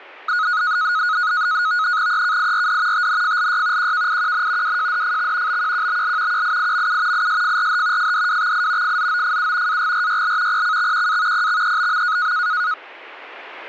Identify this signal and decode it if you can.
NAVTEX (SITOR-B), 100 baud, 170 Hz shift, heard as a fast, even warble, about 1360 Hz centre. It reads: EKIRD TNFLY QKIQN WJDFX BQQBL QIIMU ISFRH FDWXI FZOFU AGRYL PCXQA PXEBM